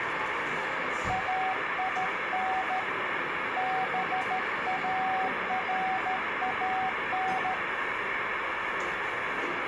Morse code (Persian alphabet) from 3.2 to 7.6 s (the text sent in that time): باران